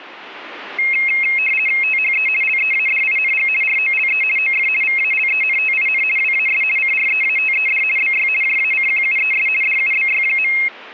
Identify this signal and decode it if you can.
RTTY (50 baud, 450 Hz shift), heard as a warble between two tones, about 2350 Hz centre. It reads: THE LEADING ROLE OF VALENTIN WAS CREATED BY JACQUES DUBY.